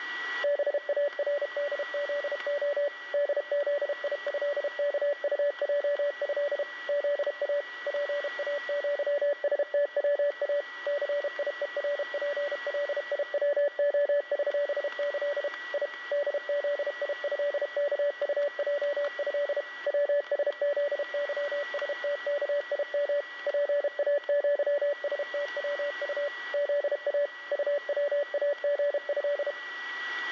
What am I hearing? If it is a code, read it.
Morse code (with Polish letters), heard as a keyed tone, machine-sent, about 32 wpm, 580 Hz, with static crashes, a steady whistle near 1940 Hz and room echo. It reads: BARDZO DZIĘKUJĘ ZA PAŃSTWA CIERPLIWOŚĆ I DZIĘKUJĘ WSZYSTKIM PAŃSTWU ZA UWAGĘ